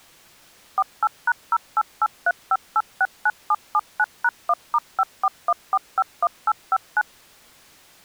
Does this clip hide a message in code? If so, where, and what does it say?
Yes: DTMF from 0.8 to 7.0 s, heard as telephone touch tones, dialled by machine, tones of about 50 ms. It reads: 48#08835869779#1*541451859